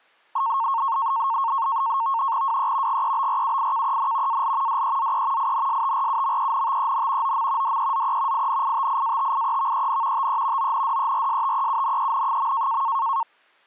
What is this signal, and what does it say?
NAVTEX (SITOR-B), 100 baud, 170 Hz shift, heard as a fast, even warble, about 1000 Hz centre. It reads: WE GEBRUIKEN AL DEZE INSTRUMENTEN OM DEZE INITIATIEVEN TE ONDERSTEUNEN.